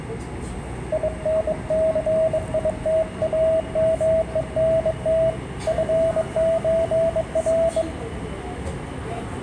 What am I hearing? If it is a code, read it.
Morse code (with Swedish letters), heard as a keyed tone, hand-sent with a bug key, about 22 wpm, 650 Hz, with room echo and the noise inside a subway train. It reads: INCITAMENT FÖR